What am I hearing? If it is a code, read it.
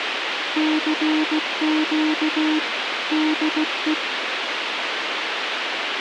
Morse code, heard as a keyed tone, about 16 wpm, 310 Hz, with radio hiss. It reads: CQ DE